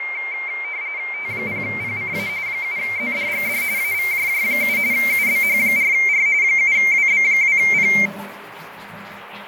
RTTY (45.45 baud, 170 Hz shift), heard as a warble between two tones, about 2200 Hz centre, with radio static, fading and the noise of a restroom. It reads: T0PCA 7ZDGD AVJJ7 UBH4R 7WB2P